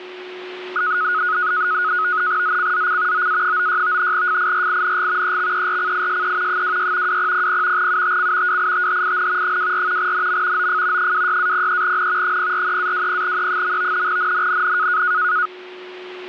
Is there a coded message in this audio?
Yes: NAVTEX (SITOR-B), 100 baud, 170 Hz shift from 0.8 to 15.5 s, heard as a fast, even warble, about 1360 Hz centre, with a steady whistle near 370 Hz. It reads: ZCZC OA96 FIRING EXERCISE 26 2000 UTC WITHIN 24 NM OF 26-03N 043-20E. NNNN